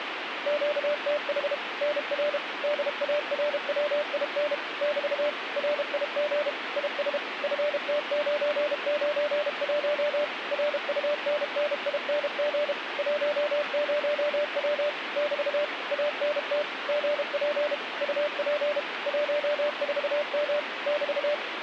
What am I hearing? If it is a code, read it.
Morse code, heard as a keyed tone, machine-sent, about 32 wpm, 590 Hz, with radio static. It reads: QTH NR DARWIN <BT> RIG IS FT991 RUNNING 10W <BT> ANT GP UP 14M <BT>